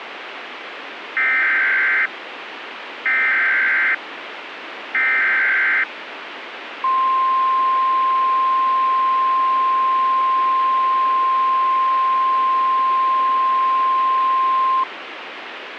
Emergency Alert System (SAME) tones (header bursts, then the 1050 Hz attention tone), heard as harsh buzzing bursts, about 520.83 baud, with radio hiss.